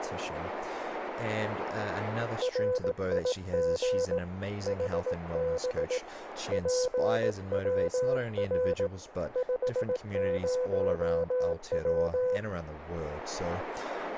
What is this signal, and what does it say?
Morse code, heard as a keyed tone, hand-sent with a paddle, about 18 wpm, 500 Hz, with radio static, a narrow filter and speech in English. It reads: RIG HB PWR 50W